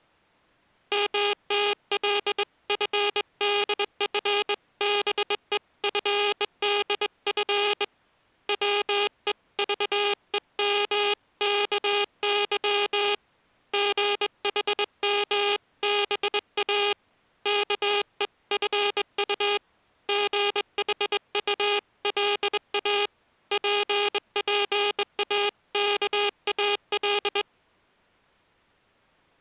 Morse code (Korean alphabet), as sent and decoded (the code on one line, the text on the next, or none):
-- - .-.. ..-. -.. ..-. -... . ..-. -.. ..-. / .-- . ...- . -- -.- -.-- / --. .... -- -... .- / -.- . ..-. ..- / --. .... ..- .-.. .- / .--. .--. .- -.- .- .-..
먹는다는 바람에 숨도 아니 쉬고 쪼옥